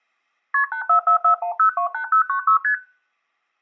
Multi-frequency trunk signalling (R1, as on North American trunks), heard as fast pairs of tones, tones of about 100 ms. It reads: KP 84441028096 ST